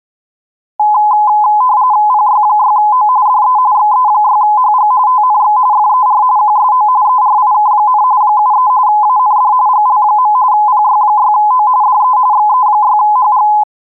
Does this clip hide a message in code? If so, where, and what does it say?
Yes: RTTY (45.45 baud, 170 Hz shift) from 0.8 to 13.6 s, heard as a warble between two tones, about 930 Hz centre. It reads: PY6O DE XE6HG TNX FER QSO ERIK, 73 AND GL. PY6O DE XE6HG